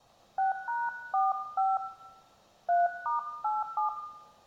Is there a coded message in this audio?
Yes: DTMF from 0.4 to 3.9 s, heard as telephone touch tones, dialled by hand, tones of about 170 ms, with room echo. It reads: 6#45 3*87